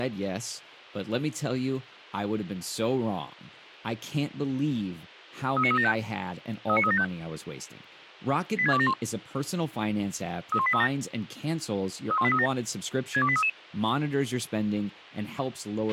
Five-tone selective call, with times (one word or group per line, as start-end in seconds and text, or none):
5.6-5.9 39375
6.7-7.0 39375
8.6-8.9 86271
10.5-10.9 31837
12.1-12.5 31837
13.1-13.5 62833